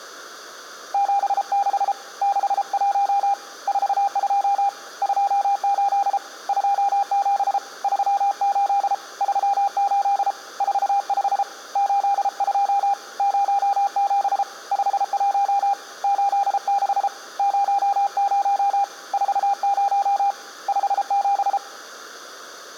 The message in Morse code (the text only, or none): 76 61 42 28 27 38 38 45 82 07 51 86 00 40 57